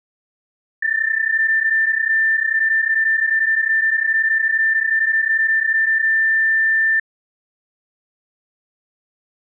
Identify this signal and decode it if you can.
PSK31 (31.25 baud), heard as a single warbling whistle, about 1800 Hz.